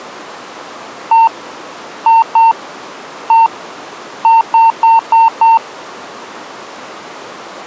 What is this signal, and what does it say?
Beep code, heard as beeps, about 910 Hz. 1-2-1-5.